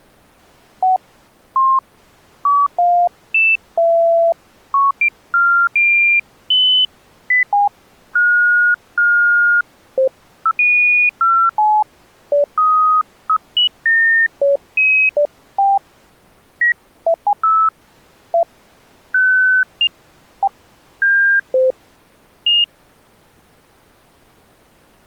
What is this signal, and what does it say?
Electronic bleeps of random pitch and length. There is no code.